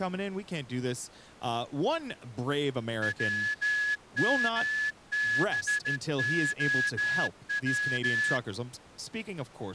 Morse code, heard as a whistle, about 14 wpm, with speech in English. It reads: WMBOW